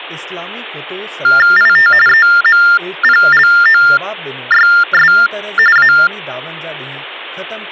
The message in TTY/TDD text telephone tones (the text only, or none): IT EMPLOYS A